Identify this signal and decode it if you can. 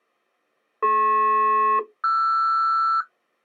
Aircraft SELCAL, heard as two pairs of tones. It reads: DP-RS